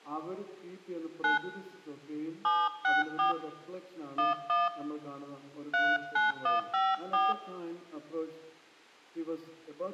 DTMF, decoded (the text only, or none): 9 764 11 39154